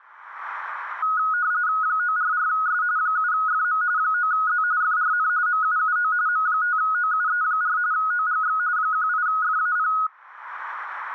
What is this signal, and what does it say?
RTTY (45.45 baud, 170 Hz shift), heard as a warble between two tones, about 1360 Hz centre. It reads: 944S 7FM 9Z FRN MUUO M5OUE4 OGX 18FAP